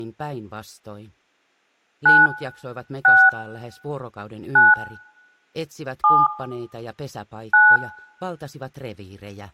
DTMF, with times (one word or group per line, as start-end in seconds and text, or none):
2.1-2.3 9
3.0-3.3 6
4.6-4.7 9
6.0-6.3 7
7.5-7.8 9